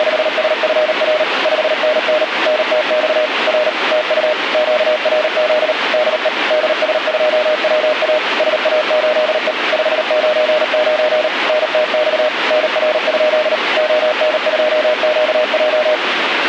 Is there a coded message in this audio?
Yes: Morse code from 0.0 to 16.0 s, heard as a keyed tone, machine-sent, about 38 wpm, 610 Hz, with radio static. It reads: … 5NN NTX R TU QRZ DE DS2WA SA8E 599 NTX NR? ON2QJ